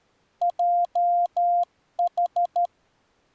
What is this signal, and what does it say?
Morse code, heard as a keyed tone, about 13 wpm, 700 Hz. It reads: JH